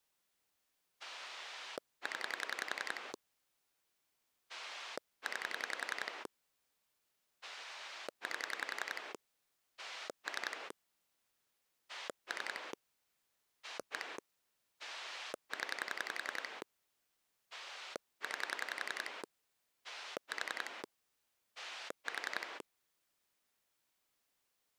Pulse dialling, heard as a rotary dial, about 11 pulses a second. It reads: 0 9 8 3 3 1 0 9 4 4